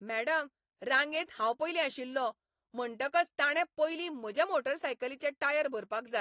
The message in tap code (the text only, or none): none